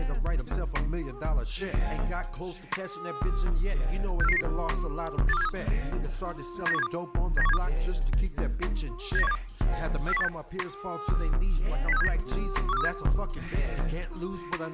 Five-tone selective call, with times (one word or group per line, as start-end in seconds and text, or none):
4.2-4.4 64499
5.3-5.5 82473
6.7-6.9 79172
7.4-7.6 79172
9.2-9.4 79172
10.1-10.3 40186
11.9-12.1 06379
12.7-12.9 14237